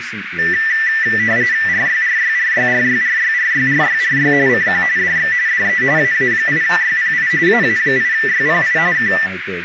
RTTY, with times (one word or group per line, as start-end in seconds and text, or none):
1.7-4.3 RYRYRYRYRYRYRYRY
4.5-4.8 CQ
5.0-5.3 DX
5.5-5.8 DE
6.0-7.3 AA8YPI
7.5-8.8 AA8YPI
9.0-9.1 K